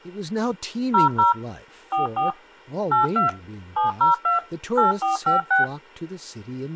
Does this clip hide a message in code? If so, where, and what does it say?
Yes: DTMF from 0.9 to 5.6 s, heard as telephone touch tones, dialled by machine, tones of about 140 ms, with speech in English. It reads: 00 44 82 702 8456